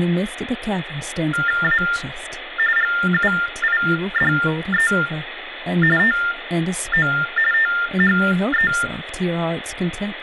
TTY/TDD text telephone tones (45.45 baud Baudot), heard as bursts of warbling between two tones, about 400 Hz shift, 1600 Hz centre, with phone line noise and speech in English. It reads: A GUIDE TO THE